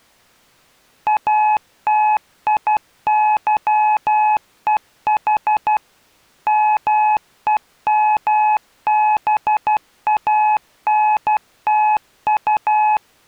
Morse code, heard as a keyed tone, machine-sent, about 12 wpm, 850 Hz. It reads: ATIYEH MEMBANTU